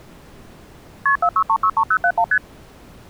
Multi-frequency trunk signalling (R1, as on North American trunks), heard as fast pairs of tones, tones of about 70 ms. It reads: KP 46363071 ST